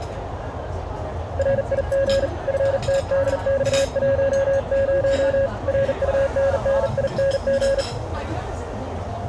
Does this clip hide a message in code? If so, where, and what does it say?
Yes: Morse code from 1.3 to 7.9 s, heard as a keyed tone, hand-sent with a bug key, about 40 wpm, 550 Hz, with radio static, a narrow filter and the noise of a restaurant. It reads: RIG FTDX10 RUNNING